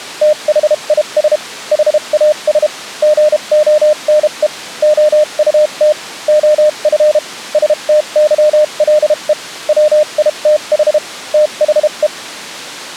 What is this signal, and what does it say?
Morse code, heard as a keyed tone, machine-sent, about 32 wpm, spaced as for 28 wpm, 610 Hz. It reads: THIS HAS GONE OUT OF STYLE WITH THE